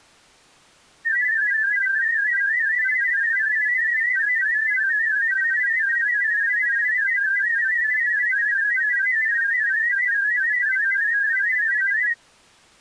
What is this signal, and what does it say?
Multi-tone FSK (Olivia or MFSK type), about 500 Hz wide, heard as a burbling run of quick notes, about 31.25 baud.